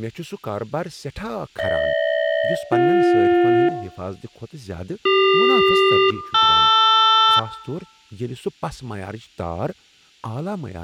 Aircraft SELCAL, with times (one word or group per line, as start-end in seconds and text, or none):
1.6-3.7 GH-BJ
5.1-7.4 CQ-LR